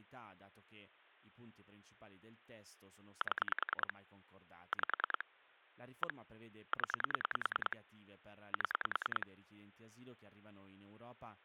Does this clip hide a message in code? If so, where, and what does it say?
Yes: pulse dialling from 3.2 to 9.2 s, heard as clicks on a phone line, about 10 pulses a second, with speech in Italian. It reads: 7 5 1 0 7